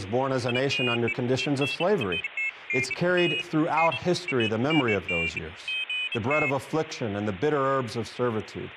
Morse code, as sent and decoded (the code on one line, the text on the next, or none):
none